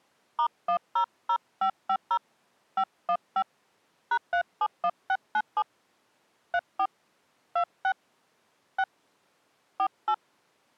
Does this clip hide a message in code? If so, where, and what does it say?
Yes: DTMF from 0.4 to 10.1 s, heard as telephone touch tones, dialled by hand, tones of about 80 ms. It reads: *100550 515 #371697 34 26 6 48